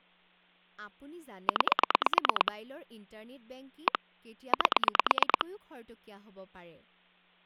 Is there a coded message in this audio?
Yes: pulse dialling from 1.5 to 5.4 s, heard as clicks on a phone line, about 9 pulses a second, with speech in Assamese. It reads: 9 1 8